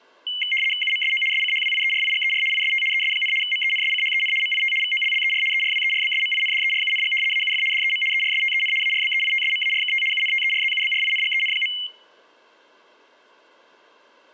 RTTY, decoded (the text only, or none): UMSO SCHWIERIGER IST ES, MENSCHEN MIT VOLLER ERWERBSMINDERUNG AUF DEM ERSTEN ARBEITSMARKT UNTERZUBRINGEN.